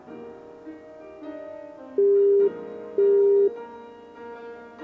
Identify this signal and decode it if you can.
Telephone call progress tone (single-tone plan, as in Europe, Japan and elsewhere), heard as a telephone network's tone, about 400 Hz, 0.5 s on and 0.5 s off. Busy tone.